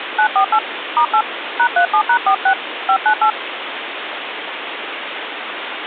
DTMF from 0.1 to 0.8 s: 948

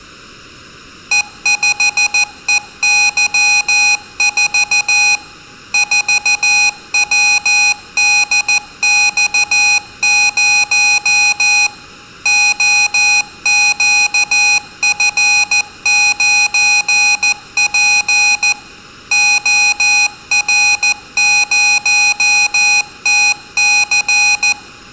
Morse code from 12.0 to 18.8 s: OQF9P

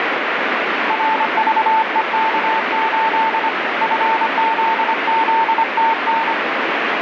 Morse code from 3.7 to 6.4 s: FZZTN

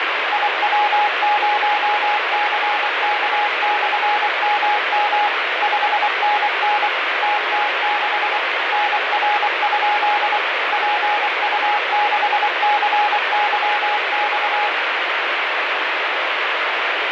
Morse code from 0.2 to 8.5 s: IW0CK/MM 5NN TT6

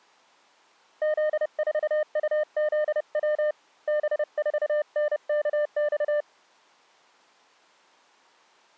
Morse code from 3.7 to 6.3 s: B4NKX

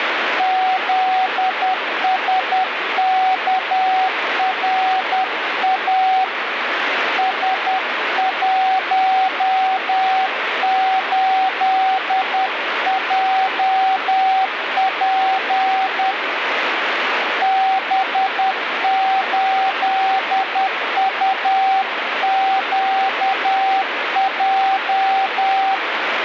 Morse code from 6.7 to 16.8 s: S18JP

